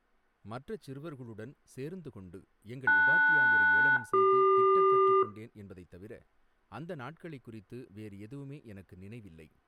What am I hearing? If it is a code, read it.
Aircraft SELCAL, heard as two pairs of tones, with speech in Tamil. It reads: LS-CQ